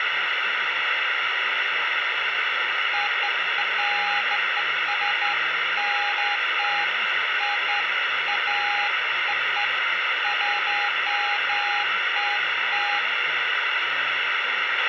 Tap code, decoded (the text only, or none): none